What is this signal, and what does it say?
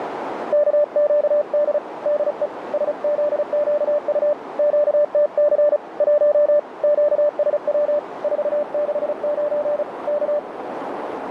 Morse code, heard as a keyed tone, hand-sent with a paddle, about 35 wpm, 590 Hz, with radio static and a narrow filter. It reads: KQD DE SZQU QTC 1 QSW 469 K